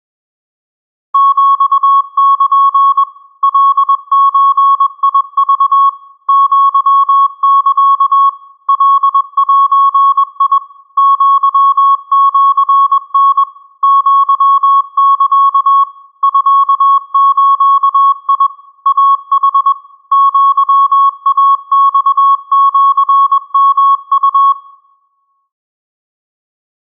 Morse code (Japanese Wabun code), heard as a keyed tone, machine-sent, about 21 wpm, 1100 Hz, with room echo. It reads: ヒル カゾク アサ カゼ アシタ アサ ミズ イヌ アイマシヨウ